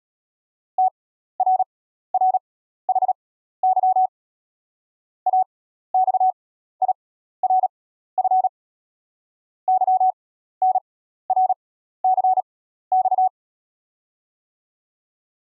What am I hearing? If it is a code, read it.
Morse code (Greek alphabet), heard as a keyed tone, machine-sent, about 37 wpm, spaced as for 14 wpm, 750 Hz. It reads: ΤΡΡΗΥ ΑΞΙΡΦ ΥΝΡΘΞ